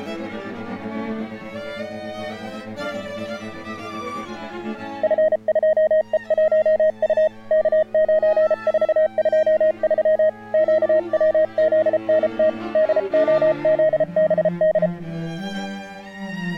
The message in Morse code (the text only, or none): F2E1U K9423 QWZNT DOZBD